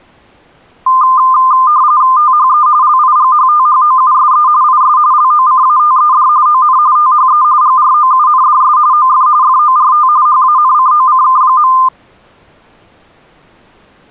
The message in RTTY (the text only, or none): THE LIGHTHOUSE IS LOCATED ON THE GROUNDS OF FORT HANCOCK.